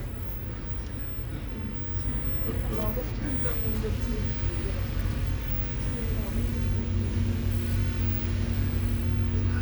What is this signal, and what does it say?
The noise inside a bus. There is no code.